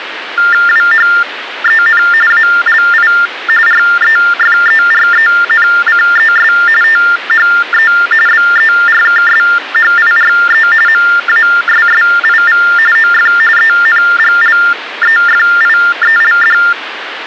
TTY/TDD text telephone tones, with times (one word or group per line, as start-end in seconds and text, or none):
0.7-2.0 WHEN
2.3-3.1 ALI
3.7-6.5 REFERENCES
6.8-7.9 THE
8.3-10.7 BERKSHIRE
10.9-12.6 MASSIV
13.0-13.3 OF
13.6-16.6 ENGLEFIELD